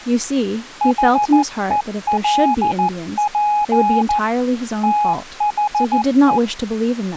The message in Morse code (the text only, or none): HELP THE